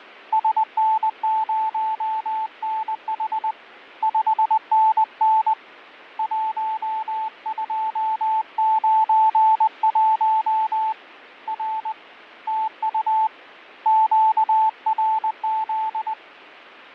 Morse code, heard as a keyed tone, hand-sent with a paddle, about 20 wpm, 880 Hz, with fading. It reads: SN0NH 5NN 1291 R TU QRZ